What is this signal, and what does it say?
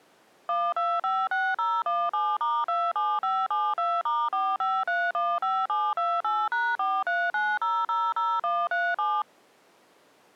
DTMF, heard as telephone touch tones, dialled by machine, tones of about 230 ms. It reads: 1256017*27572*45315728#439000137